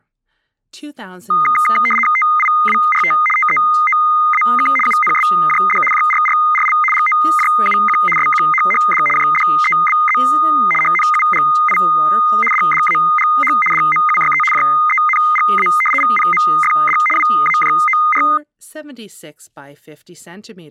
RTTY (75 baud, 850 Hz shift), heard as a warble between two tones, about 1650 Hz centre, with speech in English. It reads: TIWRT TEOAK UNSJD JRRRL GOJUQ SQHHD JDEBZ HNUGI DDAGH DMUYE JENGA VPMFD WAJOR